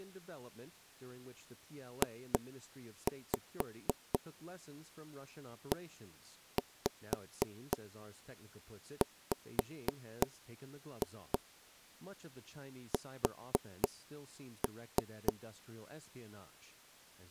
Tap code, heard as knocks on wood, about 3 knocks a second, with speech in English. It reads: JEWS